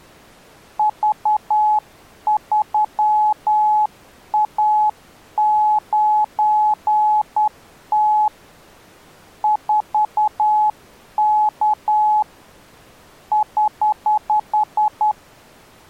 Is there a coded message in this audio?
Yes: Morse code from 0.7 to 15.2 s, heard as a keyed tone, hand-sent with a straight key, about 10 wpm, 850 Hz. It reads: V3A9T 4K <HH>